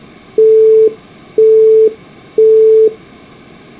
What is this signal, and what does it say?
Telephone call progress tone (single-tone plan, as in Europe, Japan and elsewhere), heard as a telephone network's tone, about 440 Hz, 0.5 s on and 0.5 s off. Busy tone.